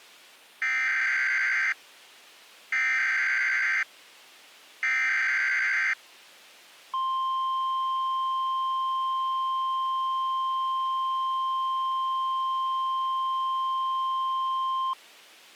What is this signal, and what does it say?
Emergency Alert System (SAME) tones (header bursts, then the 1050 Hz attention tone), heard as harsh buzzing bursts, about 520.83 baud.